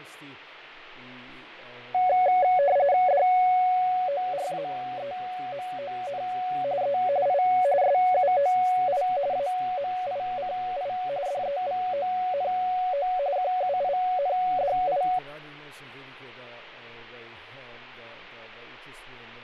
RTTY (45.45 baud, 170 Hz shift), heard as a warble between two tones, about 650 Hz centre, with radio static and fading. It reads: DORAEMON E I SUOI AMICI DEVONO QUINDI